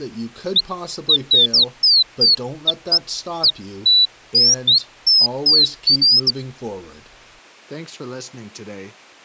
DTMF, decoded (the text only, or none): none